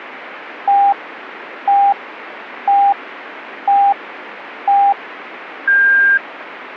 Radio time signal (five pips and a higher one, as on Chinese radio), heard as pips, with radio static.